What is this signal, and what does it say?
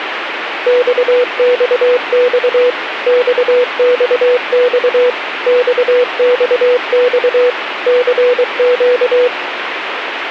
Morse code, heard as a keyed tone, machine-sent, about 23 wpm, 490 Hz, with radio static. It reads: XXX XXX XXX CQ